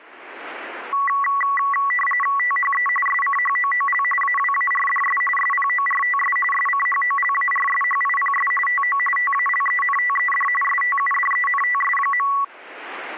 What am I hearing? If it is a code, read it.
RTTY (45.45 baud, 850 Hz shift), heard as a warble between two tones, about 1550 Hz centre. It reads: THE SCHOOL AWARDS SPORTS SCHOLARSHIPS TO TALENTED STUDENTS.